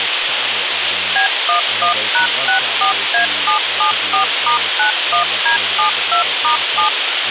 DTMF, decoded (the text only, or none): B11#64A774*91D72*7